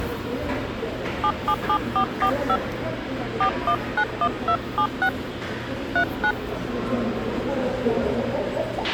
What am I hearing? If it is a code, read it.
DTMF, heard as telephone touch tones, dialled by hand, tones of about 80 ms, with a squelch burst at the end and the noise of a subway station. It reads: 777445 4191276 39